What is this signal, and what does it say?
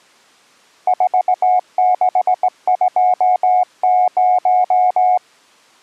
Morse code, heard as a keyed tone, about 18 wpm, 730 Hz. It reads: 4620